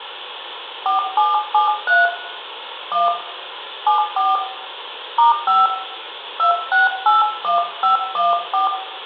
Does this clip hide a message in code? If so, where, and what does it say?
Yes: DTMF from 0.9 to 8.7 s, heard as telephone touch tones, dialled by hand, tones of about 150 ms, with room echo. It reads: 4773 1 74 *5 2681514